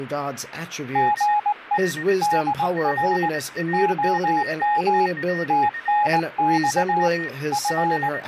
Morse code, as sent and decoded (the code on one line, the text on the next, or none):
--. . / -.. .-. / --- -- / - -. -..- / …
GE DR OM TNX …